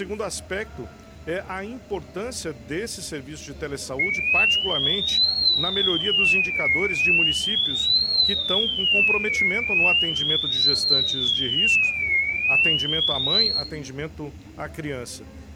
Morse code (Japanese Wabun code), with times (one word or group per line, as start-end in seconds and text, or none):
none